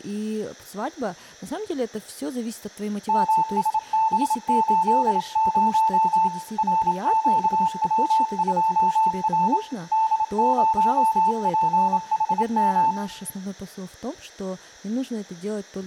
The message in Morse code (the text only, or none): MSB80 RQW2R D0PHM